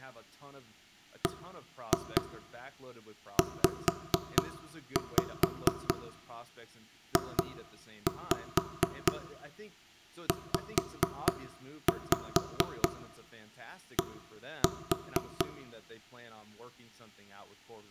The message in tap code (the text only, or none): BZJZD